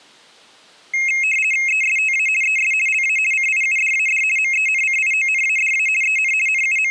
RTTY (50 baud, 450 Hz shift), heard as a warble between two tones, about 2350 Hz centre. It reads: ESTA ES LA CIUDAD MENCIONADA EN …